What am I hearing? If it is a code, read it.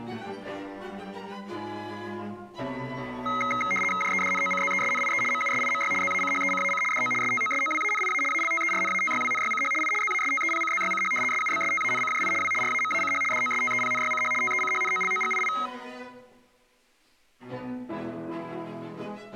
RTTY (75 baud, 850 Hz shift), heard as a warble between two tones, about 1700 Hz centre. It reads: JEDNOCZESNIE MUSIMY ZACHECAC DO STOSOWANIA ALTERNATYWNYCH I ZASTEPCZYCH SUBSTANCJI W RAMACH DOSTEPNYCH TECHNOLOGII